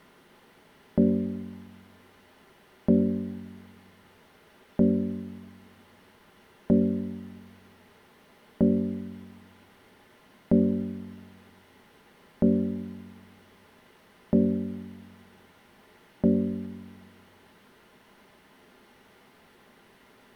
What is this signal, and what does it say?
Clock strike, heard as a bell. 9. Nine o'clock.